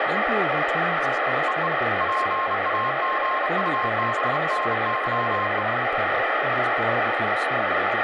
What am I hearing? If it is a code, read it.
Morse code (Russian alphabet), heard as a keyed tone, hand-sent with a bug key, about 31 wpm, 1060 Hz, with radio static and speech in English. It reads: ЕЕ ПАГУБНЫЕ